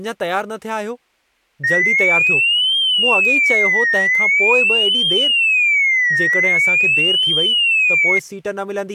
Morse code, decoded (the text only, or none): none